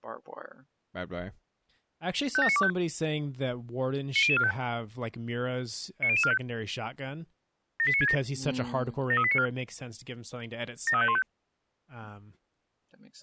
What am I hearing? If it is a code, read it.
Five-tone selective call (ZVEI), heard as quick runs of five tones, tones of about 70 ms, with speech in English. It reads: 57925 90045 90045 78967 73894 73515